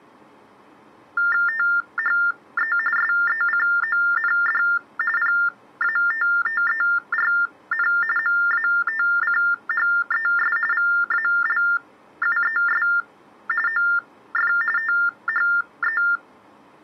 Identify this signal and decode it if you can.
TTY/TDD text telephone tones (45.45 baud Baudot), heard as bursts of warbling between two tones, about 400 Hz shift, 1600 Hz centre. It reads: THE SECOND PATTERN MATCHES VALUES OF THE